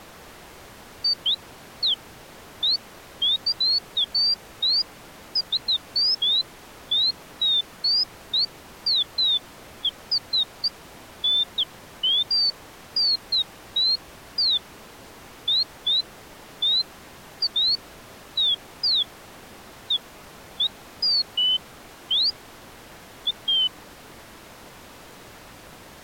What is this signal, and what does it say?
Bird-like chirps. There is no code.